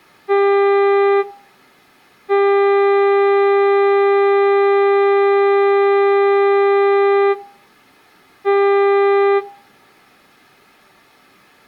Ship horn signal, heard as a ship's horn, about 400 Hz. 1 short, 1 long, 1 short. At sea: a vessel at anchor warns of its position.